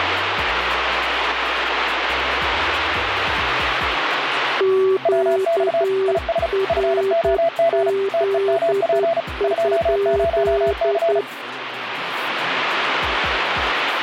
Morse code, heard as two keyed tones, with radio static. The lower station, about 10 wpm, 390 Hz: QRZ?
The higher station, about 35 wpm, 670 Hz: WX IS FOG TEMP 20C